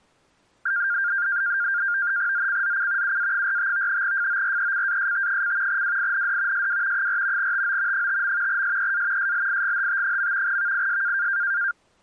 NAVTEX (SITOR-B), 100 baud, 170 Hz shift, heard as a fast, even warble, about 1500 Hz centre. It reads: ZCZC UA45 FORECAST: WIND SW 4 TO 5. SEA SLIGHT. VIS